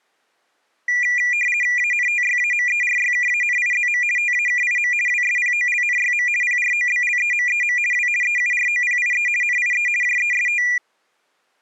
RTTY (50 baud, 450 Hz shift), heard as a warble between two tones, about 2200 Hz centre. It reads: ANTYAMERYKANIZM TAKIM WSPOLNYM PROBLEMEM W EUROPIE NIE JEST